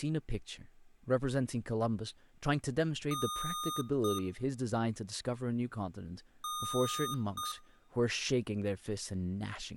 Beep code, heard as beeps from a small speaker, played twice, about 1230 Hz, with room echo and speech in English. 1 long, 1 short. In IBM BIOS tables: system board problem.